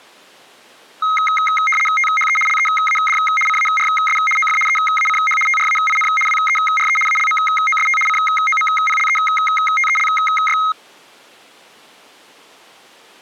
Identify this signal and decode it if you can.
RTTY (75 baud, 850 Hz shift), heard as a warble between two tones, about 1700 Hz centre. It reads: THE LEAD CARS OF EACH TRAIN WERE ALMOST COMPLETELY